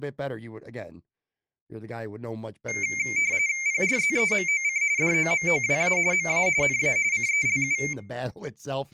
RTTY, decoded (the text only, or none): PRZEMOC DOMOWA MA NA CELU